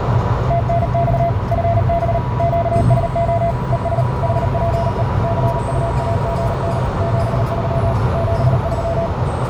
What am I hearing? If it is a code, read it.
Morse code, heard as a keyed tone, machine-sent, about 38 wpm, 680 Hz, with heavy radio static, a narrow filter and the noise inside a car. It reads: TNX FB QSO ES HPE CUAGN 73 73